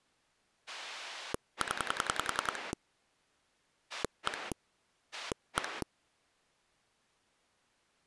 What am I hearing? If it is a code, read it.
Pulse dialling, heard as a rotary dial, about 10 pulses a second. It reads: 0 1 1